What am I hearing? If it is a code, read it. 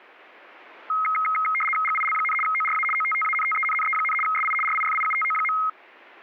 RTTY (75 baud, 850 Hz shift), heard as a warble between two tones, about 1700 Hz centre. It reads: GIL, ORA OTTANTENNE, SI RIFIUTO.